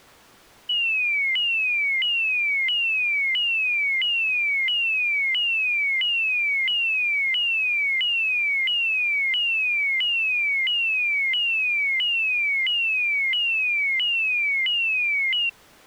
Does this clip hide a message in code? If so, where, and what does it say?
No, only a tone that sweeps in pitch again and again.